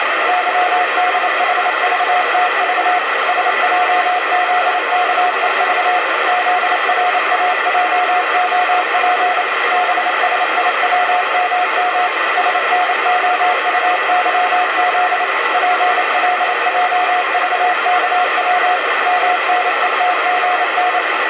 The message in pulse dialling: none

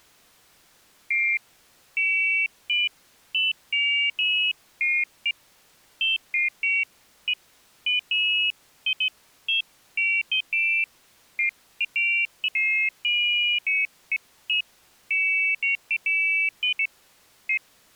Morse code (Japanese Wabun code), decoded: none

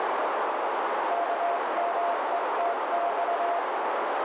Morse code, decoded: KMETX

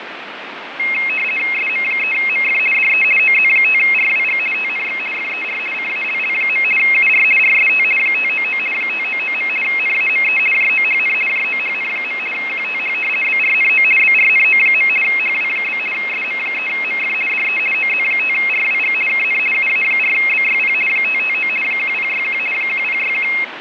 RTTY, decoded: SM3MF DE OZ5RWG TNX FER CALL. UR RST 599 599. NAME JOHN JOHN. QTH BRNO BRNO. HW? SM3MF DE OZ5RWG KN UA4BYP 559 1061 1061

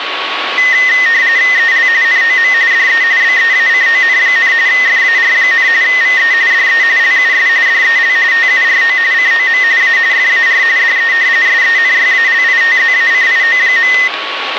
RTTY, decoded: EL NOM DE BEACON, FAR, VE DE LUS DEL TURO COM A FAR DE SENYALITZACIO.

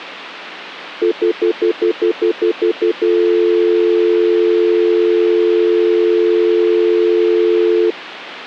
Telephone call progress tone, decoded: stutter dial tone

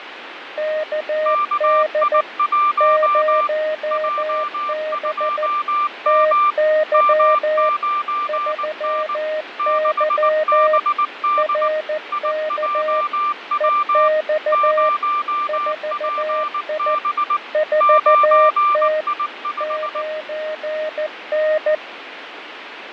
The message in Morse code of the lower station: KD 0B TY 3Y RK EX 4I 4T 9N

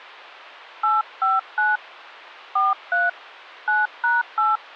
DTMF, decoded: 859 43 9#8

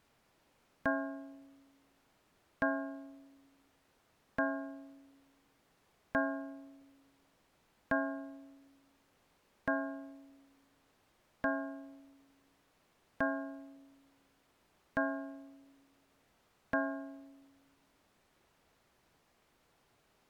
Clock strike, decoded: 10

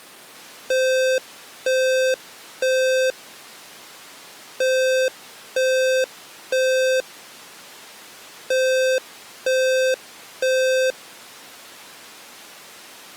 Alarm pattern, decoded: temporal three

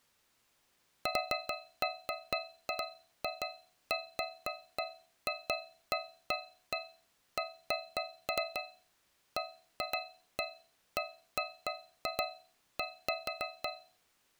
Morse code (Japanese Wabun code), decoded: none

